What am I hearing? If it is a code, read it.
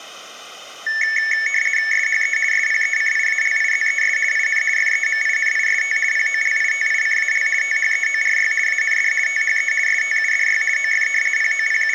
RTTY (50 baud, 450 Hz shift), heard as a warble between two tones, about 2000 Hz centre. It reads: SHE SPECIALIZES IN FEMINIST POLITICAL THEORY AND THE STUDY OF …